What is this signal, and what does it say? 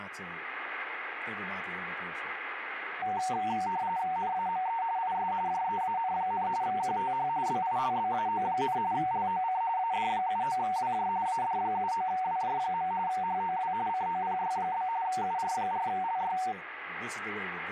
RTTY (45.45 baud, 170 Hz shift), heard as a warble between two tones, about 830 Hz centre, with radio static and speech in English. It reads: NAME IS JEAN, QTH BILBAO, LOC AD79WJ AD79WJ. HOW COPY? UR4LY